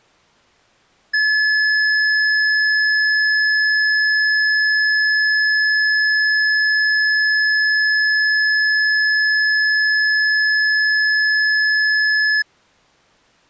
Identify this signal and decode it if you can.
A steady tone. There is no code.